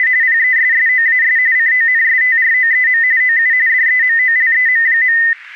RTTY (45.45 baud, 170 Hz shift), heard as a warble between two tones, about 1900 Hz centre, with static crashes. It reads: … PESSOAS CONSTROEM OU DEMOLEM.